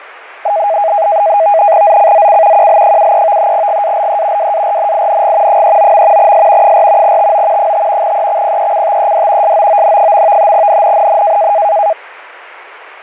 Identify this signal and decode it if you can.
NAVTEX (SITOR-B), 100 baud, 170 Hz shift, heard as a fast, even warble, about 730 Hz centre. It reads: ZCZC QL73 GALE WARNING 39. S 4 TO 5 EXPECTED SOON. NNNN